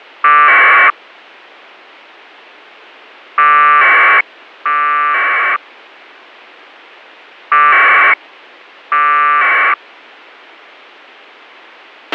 Packet radio (AX.25, as in APRS), 1200 baud, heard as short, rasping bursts, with a squelch burst at the end.